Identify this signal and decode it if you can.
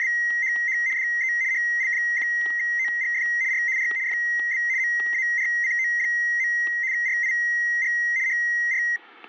RTTY (75 baud, 170 Hz shift), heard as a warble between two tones, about 2000 Hz centre, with static crashes. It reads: … DE HL1OGF R R FB MARCO. RIG HR